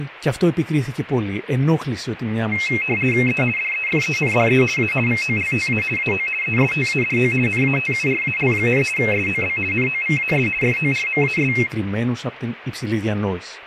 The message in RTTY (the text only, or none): E DEFENDE A VOLTA AO ESTADO NATURAL, SOB NOVAS FORMAS